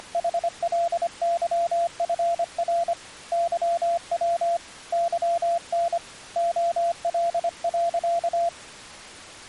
Morse code, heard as a keyed tone, hand-sent with a paddle, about 25 wpm, 680 Hz. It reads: … YW YN OL.